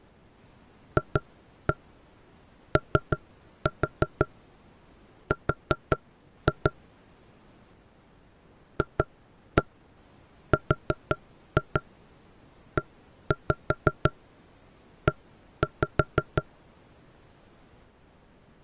Tap code, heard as knocks on wood, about 5 knocks a second. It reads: FOR FREE